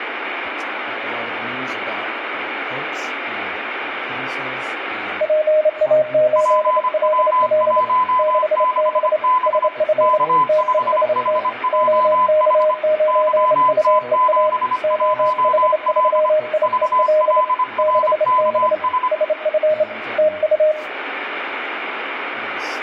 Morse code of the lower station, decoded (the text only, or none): PA8LL 6B SF TEST OK9UEA OH3IEL 6B SF TU